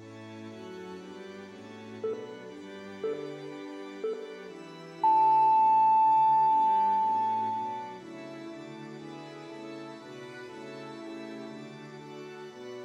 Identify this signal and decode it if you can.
Radio time signal (three low pips and a long one an octave up, as on NHK), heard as pips, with room echo.